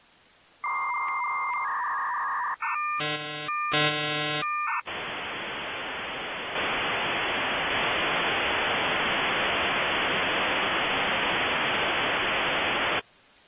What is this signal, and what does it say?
Dial-up modem handshake (V.34 or later), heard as a whistle, warbles, then hiss.